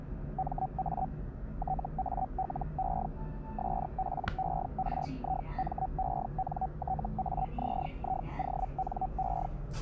Hellschreiber (Feld-Hell, 122.5 baud), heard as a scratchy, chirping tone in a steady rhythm, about 760 Hz, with the noise inside a lift. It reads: MA TALE SPERIMENTAZIONE